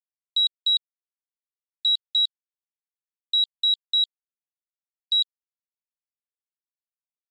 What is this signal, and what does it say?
Beep code, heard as a piezo beeper, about 3850 Hz. 2-2-3-1. In Phoenix BIOS tables: unexpected interrupt.